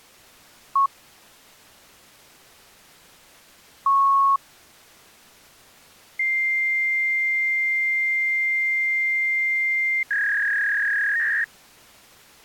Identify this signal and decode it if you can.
Fax machine handshake, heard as a beep, a long tone and a warble.